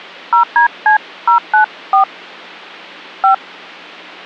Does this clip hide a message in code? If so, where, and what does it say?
Yes: DTMF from 0.3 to 3.3 s, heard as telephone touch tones, dialled by hand, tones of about 110 ms. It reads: 0DC094 5